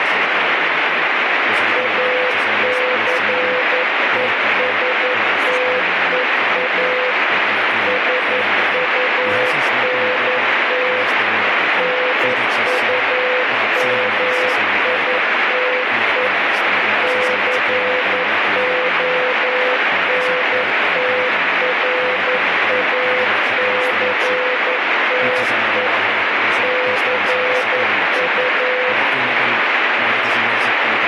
Morse code, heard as a keyed tone, machine-sent, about 11 wpm, 500 Hz, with heavy radio static and speech in Finnish. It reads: ACESTEA SUNT NUMITE CONTRACTE CU